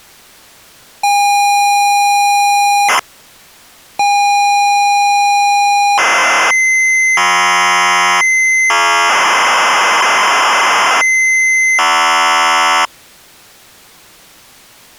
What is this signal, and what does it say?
ZX Spectrum tape loading, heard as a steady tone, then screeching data.